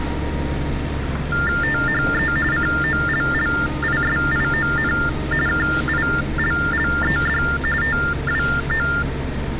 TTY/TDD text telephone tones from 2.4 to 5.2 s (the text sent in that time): COLLISION